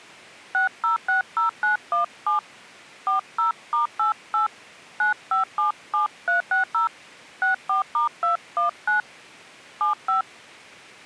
DTMF, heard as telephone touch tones, dialled by hand, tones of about 130 ms. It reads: 6060917 40*88 9577360 64*219 75